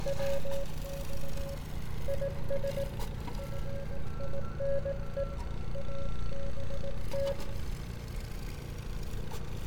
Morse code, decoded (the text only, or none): WX IS FINE ABT